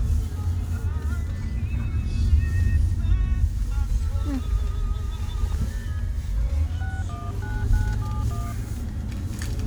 DTMF, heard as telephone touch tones, dialled by hand, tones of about 220 ms, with the noise inside a car. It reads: 619971